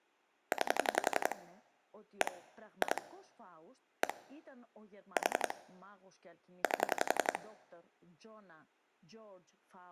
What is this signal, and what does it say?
Pulse dialling, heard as clicks on a phone line, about 11 pulses a second, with speech in Greek. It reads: 9 1 2 1 4 8